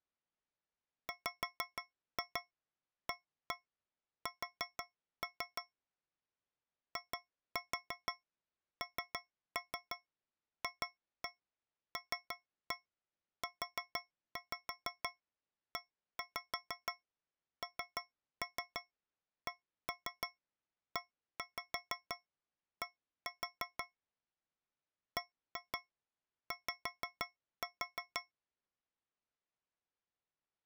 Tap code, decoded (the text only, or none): WAS INFLUENCED BY